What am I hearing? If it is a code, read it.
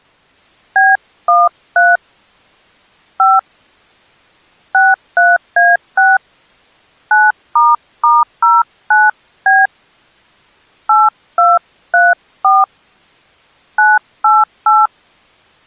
DTMF, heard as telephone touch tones, dialled by hand, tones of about 200 ms. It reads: B13 5 63A6 9**09B 8234 988